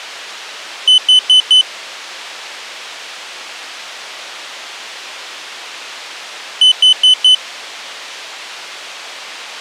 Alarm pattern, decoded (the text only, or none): temporal four